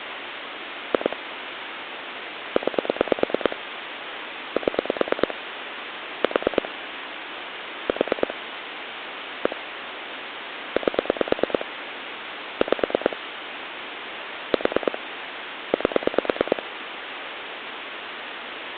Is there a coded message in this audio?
Yes: pulse dialling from 0.9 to 16.6 s, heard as clicks on a phone line, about 9 pulses a second, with phone line noise. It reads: 2 9 7 4 4 1 8 5 4 8